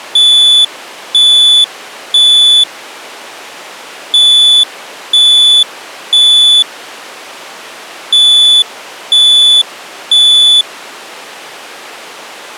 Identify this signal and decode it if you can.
Alarm pattern, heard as an alarm's beeps, played three times, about 3450 Hz. Temporal three. Smoke or fire, evacuate.